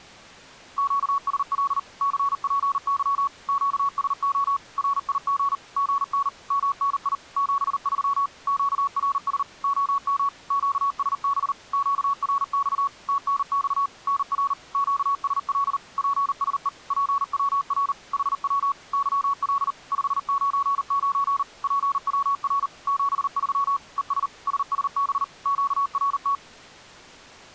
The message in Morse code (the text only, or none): QSL CPY QSO RIG GN MNI 73 QRS OM QSB QRX TNX NR QSL PSE PWR HW YL 599 PWR 73 ES SSB QRT